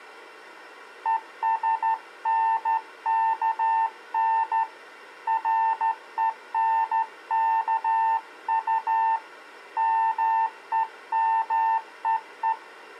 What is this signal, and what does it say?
Morse code, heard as a keyed tone, hand-sent with a straight key, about 13 wpm, 900 Hz. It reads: ESNKN RENKU MEMEE